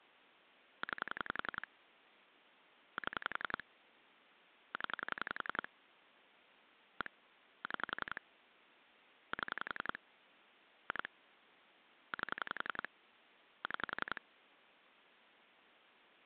Pulse dialling, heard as clicks on a phone line, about 11 pulses a second. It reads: 9 7 0 1 6 7 2 8 6